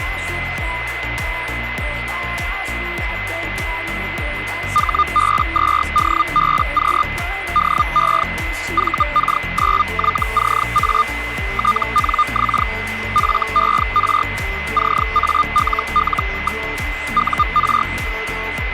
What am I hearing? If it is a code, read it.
Hellschreiber (Feld-Hell, 122.5 baud), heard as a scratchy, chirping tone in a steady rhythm, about 1210 Hz, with radio static and a steady whistle near 2040 Hz. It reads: HB2DBQ DE VK9YCA TNX FER CALL. UR